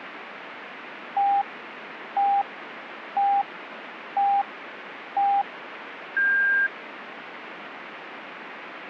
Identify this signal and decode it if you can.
Radio time signal (five pips and a higher one, as on Chinese radio), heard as pips, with radio static.